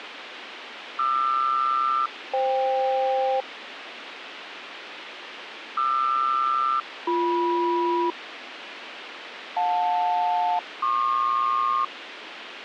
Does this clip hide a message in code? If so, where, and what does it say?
Yes: aircraft SELCAL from 1.0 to 11.8 s, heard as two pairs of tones, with radio hiss. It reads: QR-FK QR-BM JL-PQ